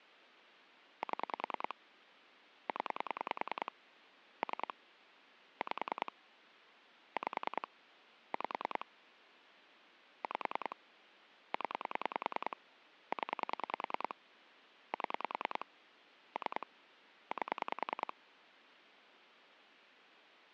Pulse dialling, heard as clicks on a phone line, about 10 pulses a second. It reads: 7 0 3 5 5 5 5 0 0 7 3 8